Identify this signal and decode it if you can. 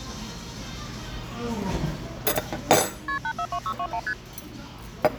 Multi-frequency trunk signalling (R1, as on North American trunks), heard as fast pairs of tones, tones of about 70 ms, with the noise of a restaurant. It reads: KP 842621 ST